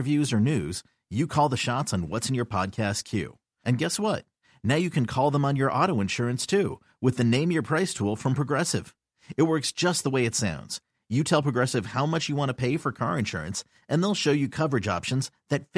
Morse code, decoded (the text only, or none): none